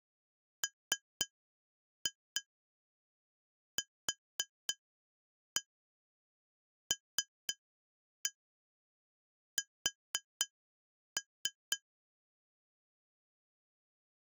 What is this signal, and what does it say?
Tap code, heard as taps on glass, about 3 knocks a second. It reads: MQLS